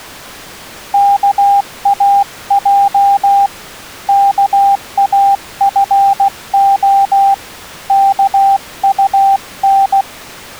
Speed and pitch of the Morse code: 16 wpm, 790 Hz

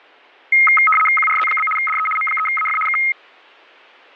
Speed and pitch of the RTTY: 75 baud, 850 Hz shift, 1700 Hz centre

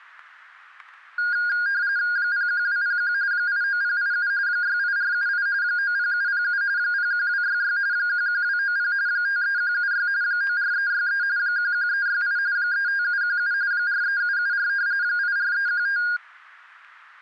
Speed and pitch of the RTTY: 45.45 baud, 170 Hz shift, 1550 Hz centre

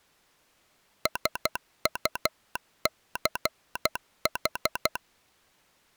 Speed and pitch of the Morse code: 12 wpm

